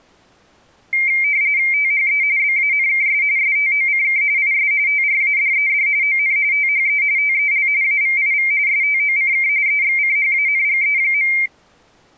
RTTY (45.45 baud, 170 Hz shift), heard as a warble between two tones, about 2200 Hz centre. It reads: THE BANKS STOCK IS TRADED ON THE TEL AVIV STOCK EXCHANGE.